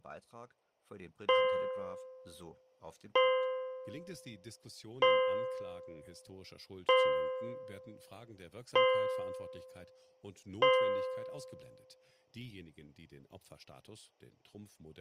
Clock strike, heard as a bell, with speech in German. 6. Six o'clock.